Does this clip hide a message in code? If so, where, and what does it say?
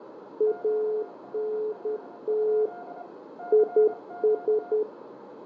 Yes: Morse code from 0.3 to 4.9 s, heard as two keyed tones, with radio static, fading, a narrow filter and room echo. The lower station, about 10 wpm, 430 Hz: ANT IS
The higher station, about 25 wpm, 710 Hz: QRL? CQ